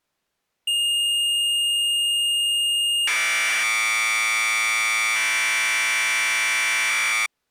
Commodore tape loading (standard loader), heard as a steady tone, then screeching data.